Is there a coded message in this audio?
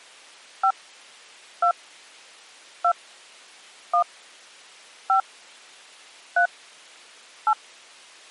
Yes: DTMF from 0.6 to 7.5 s, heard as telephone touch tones, dialled by hand, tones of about 80 ms. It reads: 5 2 2 1 5 3 8